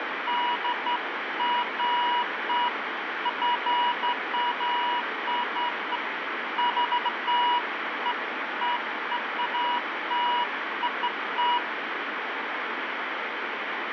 Beeps of irregular length, with radio static. There is no code.